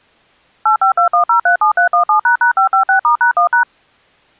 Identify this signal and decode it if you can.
DTMF, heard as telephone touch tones, dialled by machine, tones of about 110 ms. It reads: 8521037317##556*#1#